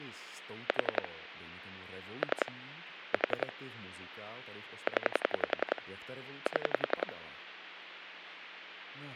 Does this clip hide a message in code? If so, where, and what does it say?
Yes: pulse dialling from 0.7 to 7.1 s, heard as clicks on a phone line, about 11 pulses a second, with speech in Czech. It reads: 4 3 4 0 7